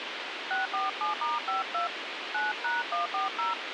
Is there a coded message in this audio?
Yes: DTMF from 0.5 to 3.5 s, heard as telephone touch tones, dialled by hand, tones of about 150 ms, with radio hiss. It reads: 647*52 9#140